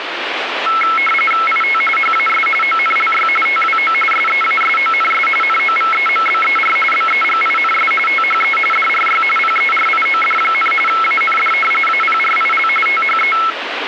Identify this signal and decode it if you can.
RTTY (45.45 baud, 850 Hz shift), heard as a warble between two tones, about 1750 Hz centre, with radio static. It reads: IT HAS ONLY TWO SEASONS NOVEMBER BEGINS THE DRY PERIOD, AND APRIL THE